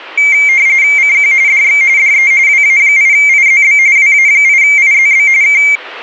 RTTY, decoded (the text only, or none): CQ DX DE WA8IZB WA8IZB K